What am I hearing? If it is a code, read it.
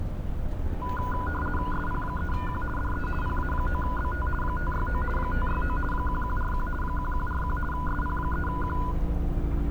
RTTY (50 baud, 450 Hz shift), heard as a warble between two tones, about 1220 Hz centre, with static crashes and street noise. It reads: SP3Q DE PA9BT 569 569 1141 1141 SP3Q